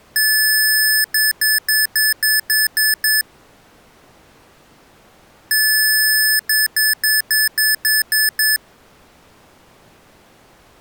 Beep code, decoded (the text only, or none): 1 long, 8 short